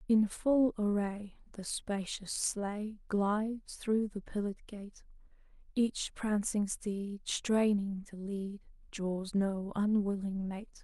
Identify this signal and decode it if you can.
Speech in English. There is no code.